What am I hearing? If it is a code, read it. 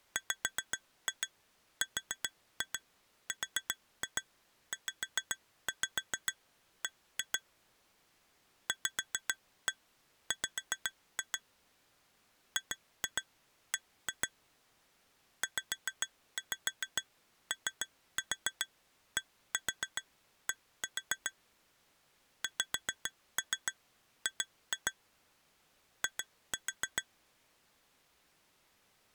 Tap code, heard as taps on glass, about 7 knocks a second. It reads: WRRZB VW GB ZODD XG I